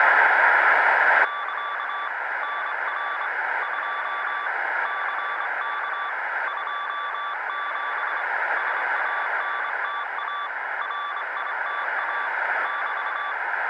Morse code, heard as a keyed tone, hand-sent with a straight key, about 25 wpm, 1160 Hz, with radio static, a narrow filter and room echo. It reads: <KA> NR 2 CK 27 SANTA RITA <BT>